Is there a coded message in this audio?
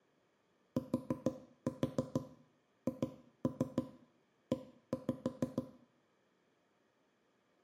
Yes: tap code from 0.8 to 5.7 s, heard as knocks on wood, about 6 knocks a second, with room echo. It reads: THE